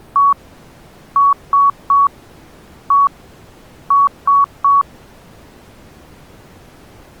Beep code, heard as beeps, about 1120 Hz. 1-3-1-3. In Phoenix BIOS tables: keyboard controller test failure.